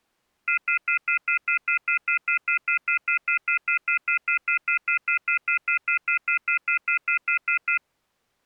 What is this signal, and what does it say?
Telephone call progress tone (North American plan), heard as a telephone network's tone, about 1400, 2050, 2450, 2600 Hz, 0.1 s on and 0.1 s off. Off-hook warning tone.